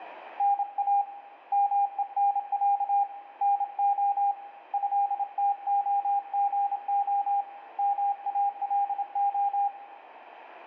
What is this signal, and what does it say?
Morse code (Russian alphabet), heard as a keyed tone, hand-sent with a paddle, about 27 wpm, 800 Hz, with radio static and room echo. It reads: НА МЕНЯ НО ЭТОГО МАЛО